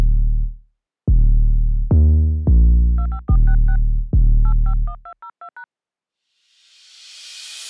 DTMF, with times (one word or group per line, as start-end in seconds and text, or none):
3.0-3.8 25466
4.5-5.6 851202#